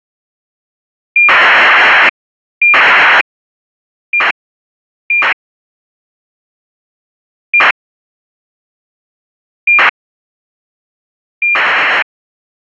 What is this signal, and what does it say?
ACARS aircraft data, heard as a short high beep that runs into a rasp, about 2400 baud.